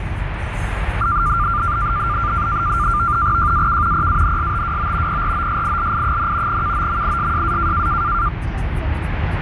NAVTEX (SITOR-B), 100 baud, 170 Hz shift, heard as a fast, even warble, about 1280 Hz centre, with radio static and the noise inside a car. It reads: JAK PANSTWO PROSILI, KOMISJA